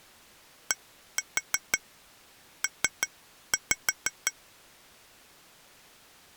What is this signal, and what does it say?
Tap code, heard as taps on glass, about 5 knocks a second. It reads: DP